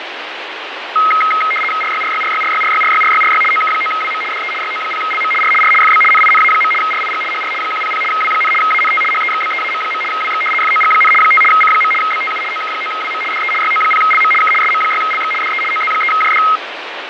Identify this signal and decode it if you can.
RTTY (75 baud, 850 Hz shift), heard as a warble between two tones, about 1700 Hz centre, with radio static and fading. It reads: RYRYRYRYRYRYRYRY OK9WM DE YO0LM R R FB NINA. RIG HR 100 W, ANT HEXBEAM. WX FOG, 5 C. BTU OK9WM DE YO0LM K SM6LX DE OZ3JD